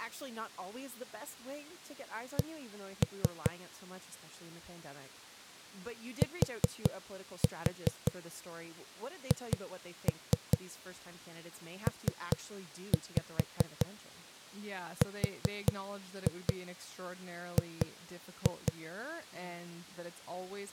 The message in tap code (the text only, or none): C THPRG